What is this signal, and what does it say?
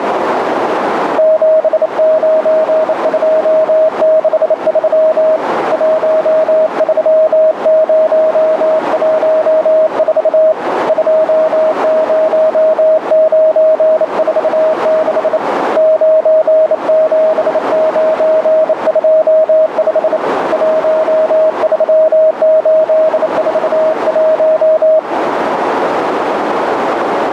Morse code, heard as a keyed tone, hand-sent with a bug key, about 28 wpm, 630 Hz, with radio static and a narrow filter. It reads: 79263 13014 20946 97925 13841